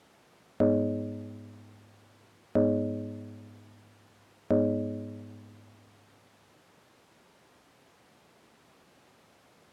Clock strike, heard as a bell. 3. Three o'clock.